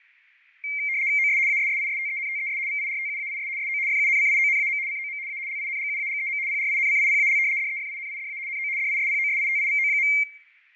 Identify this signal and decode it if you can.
RTTY (75 baud, 170 Hz shift), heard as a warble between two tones, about 2200 Hz centre, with fading. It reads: OS ASSISTENTES VIRTUAIS SO FUNCIONAM COM A LINGUAGEM PRINCIPAL DEFINIDA NO DISPOSITIVO.